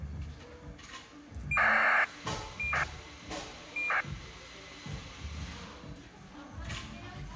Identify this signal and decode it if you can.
ACARS aircraft data, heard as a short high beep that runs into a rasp, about 2400 baud, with the noise of a cafe.